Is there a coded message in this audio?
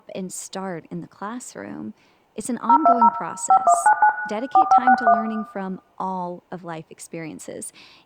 Yes: DTMF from 2.7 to 5.1 s, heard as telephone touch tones, dialled by hand, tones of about 70 ms, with room echo and speech in English. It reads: 020 5199 4561